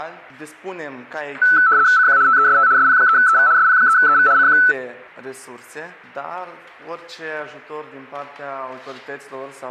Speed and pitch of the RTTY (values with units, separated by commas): 75 baud, 170 Hz shift, 1410 Hz centre